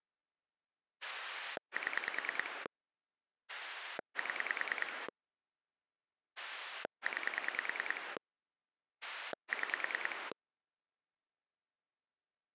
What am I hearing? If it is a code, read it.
Pulse dialling, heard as a rotary dial, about 10 pulses a second. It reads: 7 7 9 6